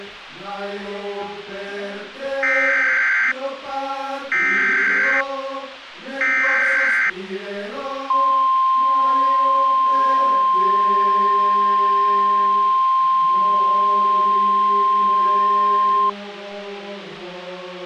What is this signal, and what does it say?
Emergency Alert System (SAME) tones (header bursts, then the 1050 Hz attention tone), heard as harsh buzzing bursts, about 520.83 baud, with radio hiss.